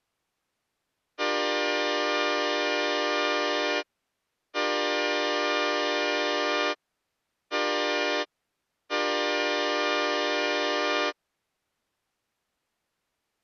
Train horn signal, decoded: 2 long, 1 short, 1 long

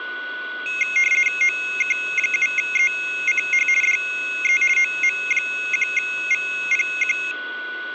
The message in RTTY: OK7ECH DE OM1VPQ

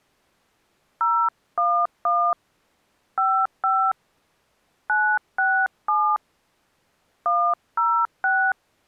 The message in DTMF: 011 55 967 106

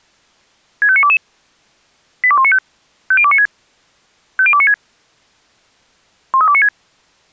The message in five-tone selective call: 65922 82195 50296 50296 13296

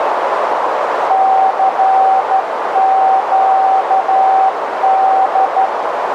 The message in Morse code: CQD

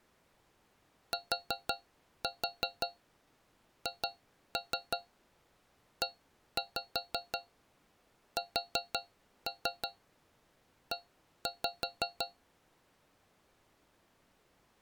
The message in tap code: THESE

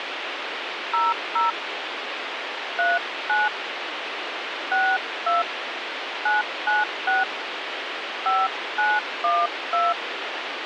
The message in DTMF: 00 39 62 996 5912

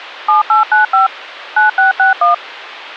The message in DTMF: 7895 9661

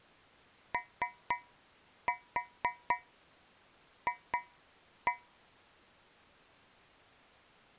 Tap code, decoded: OF

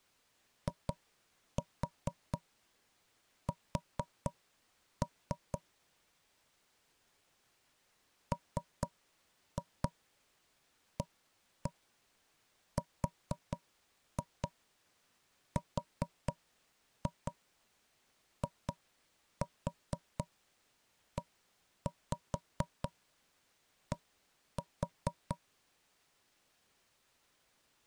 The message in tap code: IS MARRIED

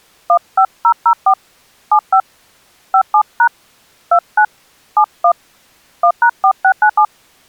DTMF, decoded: 15004 75 57# 29 71 1#4697

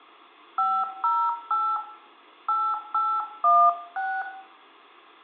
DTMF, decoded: 508 8816

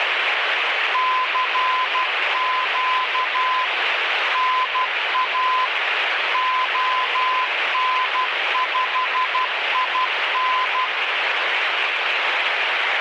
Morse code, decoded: CQ NA ON5IN

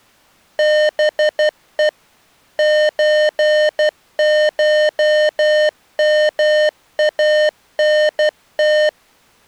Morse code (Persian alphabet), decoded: به چشمانت

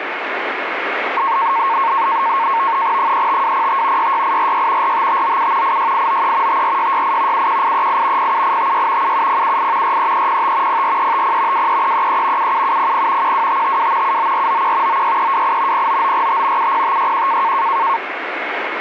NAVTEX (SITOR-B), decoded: 35205 66846 45597 86893 54668 71838 07856 77078 43305 04350 23333 77700 12552 79491 96328 09945 70561

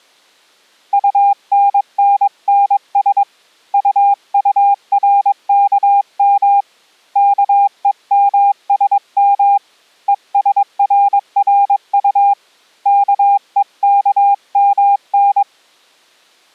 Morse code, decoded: UNNNS UURKM KEMSM ESRRU KEKMN

